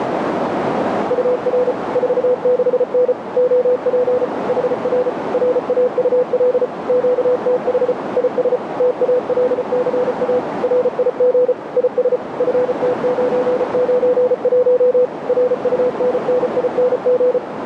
Morse code, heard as a keyed tone, machine-sent, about 34 wpm, 500 Hz, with heavy radio static and a narrow filter. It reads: UR 46N OP HR RAUL QTH IS TALCA RIG IS FT991 RUNNING